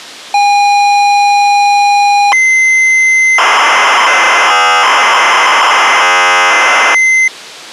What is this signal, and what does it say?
ZX Spectrum tape loading, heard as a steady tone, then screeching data.